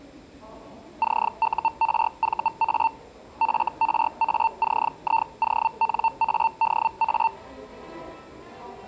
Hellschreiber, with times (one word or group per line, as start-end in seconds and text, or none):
1.0-2.9 CURVA
3.4-7.3 FRACIONADA